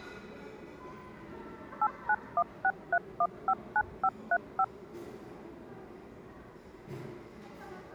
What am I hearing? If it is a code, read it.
DTMF, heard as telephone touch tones, dialled by machine, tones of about 60 ms, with the noise of a restaurant. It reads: 89163159535